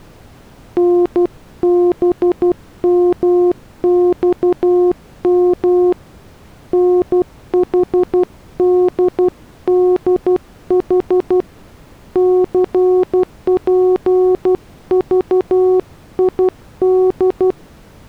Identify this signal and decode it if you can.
Morse code, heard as a keyed tone, hand-sent with a paddle, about 12 wpm, 360 Hz. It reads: NBMXM NHDDH CPVID